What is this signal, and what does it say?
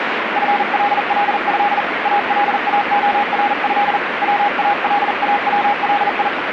Morse code (Arabic alphabet), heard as a keyed tone, hand-sent with a paddle, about 40 wpm, 820 Hz, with radio static. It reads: فلله الاخره والاولي